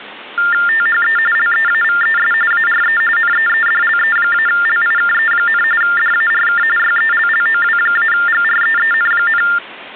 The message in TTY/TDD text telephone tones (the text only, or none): THE LEAVES ARE NEEDLE-LIKE, DARK YELLOW-GREEN,